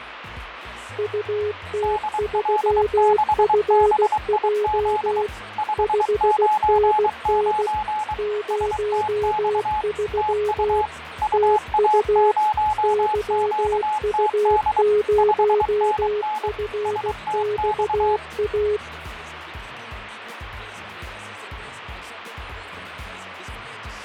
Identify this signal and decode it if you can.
Morse code, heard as two keyed tones, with radio static and fading. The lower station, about 16 wpm, 420 Hz: UT3FJ 5NN 03 TU YU0FXA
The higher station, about 23 wpm, 850 Hz: DL6BIZ 599 STX TU UA0QTD 5NN STX